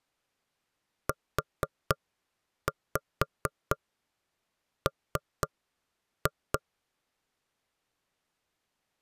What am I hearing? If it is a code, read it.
Tap code, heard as knocks on wood, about 4 knocks a second. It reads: UM